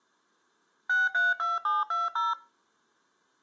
DTMF, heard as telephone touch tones, dialled by machine, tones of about 180 ms. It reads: 632720